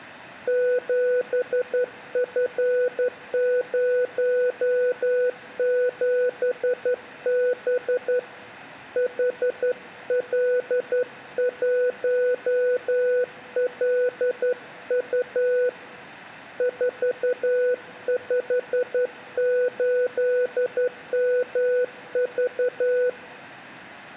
Morse code, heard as a keyed tone, hand-sent with a straight key, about 11 wpm, 500 Hz, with room echo. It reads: 7F07B HL1LU 458MV